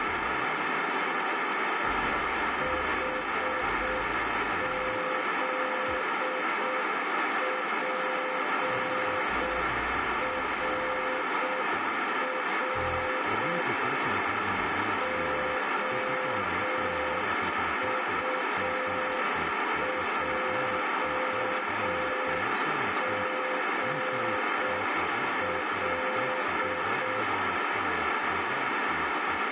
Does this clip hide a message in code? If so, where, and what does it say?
Yes: Morse code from 2.6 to 27.3 s, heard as a keyed tone, machine-sent, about 6 wpm, 510 Hz, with heavy radio static. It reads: HZPRR OUJGL